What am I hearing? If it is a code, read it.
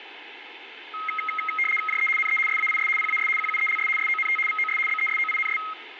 RTTY (75 baud, 850 Hz shift), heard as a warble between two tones, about 1700 Hz centre, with radio static. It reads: JE NE SAIS PAS QUELS SONT VOS BESOINS